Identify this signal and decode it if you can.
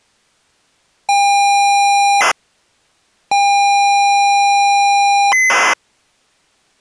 ZX Spectrum tape loading, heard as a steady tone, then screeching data.